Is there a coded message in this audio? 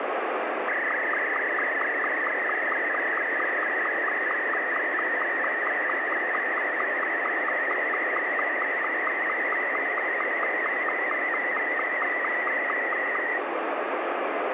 Yes: SSTV (slow-scan television), Martin M2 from 0.7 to 13.4 s, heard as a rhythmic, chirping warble, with radio static.